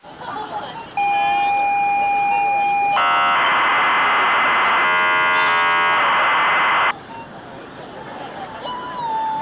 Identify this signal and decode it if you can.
ZX Spectrum tape loading, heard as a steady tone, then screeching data, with the noise of a park.